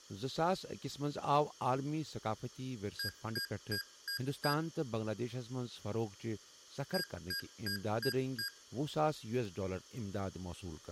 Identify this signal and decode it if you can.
Beep code, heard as beeps from a small speaker, played twice, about 1600 Hz, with room echo and speech in Kashmiri. 5 short. In AMI BIOS tables: processor failure; in Dell tables: CMOS battery failure.